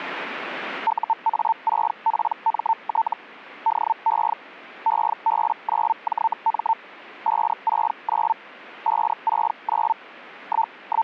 Hellschreiber (Feld-Hell, 122.5 baud), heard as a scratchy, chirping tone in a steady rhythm, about 900 Hz. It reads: UA6PMT DE EB9JM 569 569 …